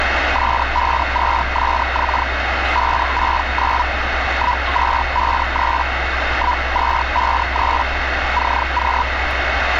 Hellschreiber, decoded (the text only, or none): S52SX 569 1253 1253 CQ